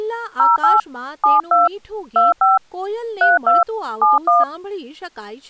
DTMF, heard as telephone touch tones, dialled by hand, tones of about 170 ms, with speech in Gujarati. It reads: 08 72 25 32 71